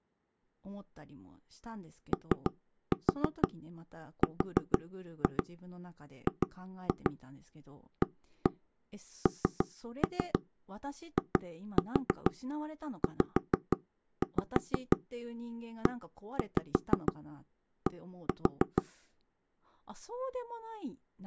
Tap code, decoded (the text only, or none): ORGANIZED